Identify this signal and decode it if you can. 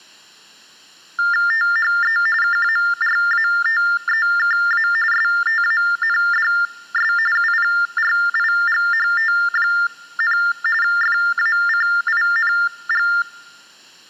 TTY/TDD text telephone tones (45.45 baud Baudot), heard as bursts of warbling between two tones, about 400 Hz shift, 1600 Hz centre. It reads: THE KARATEKA STANDS UPRIGHT, FACING